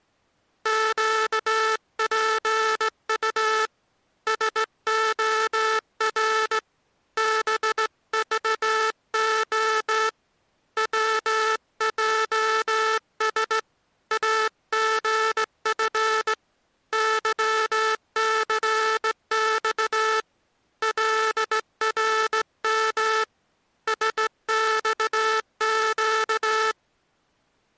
Morse code, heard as a buzzer, hand-sent with a straight key, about 16 wpm. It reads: QPU SOR BVO WJS AGF YCX LRM SXQ